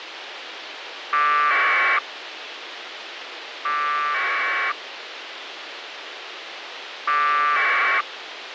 Packet radio (AX.25, as in APRS), 1200 baud, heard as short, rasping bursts, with radio hiss.